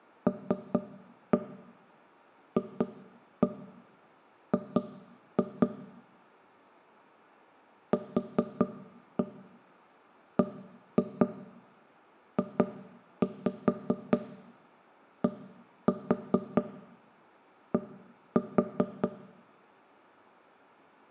Tap code, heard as knocks on wood, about 4 knocks a second, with room echo. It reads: LFG QBJDD